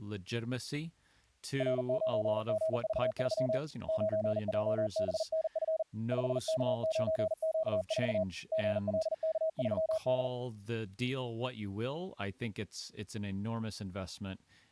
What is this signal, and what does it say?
Morse code, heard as a keyed tone, hand-sent with a paddle, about 40 wpm, 640 Hz, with speech in English. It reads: R9GV3 9JBNF 5K9Q4 GLK3D